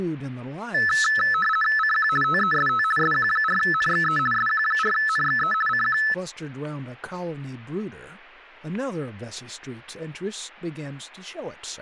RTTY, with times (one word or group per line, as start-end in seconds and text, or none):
1.8-2.1 CQ
2.2-2.8 TEST
3.0-4.2 SQ4NXE
4.3-5.5 SQ4NXE
5.7-6.0 CQ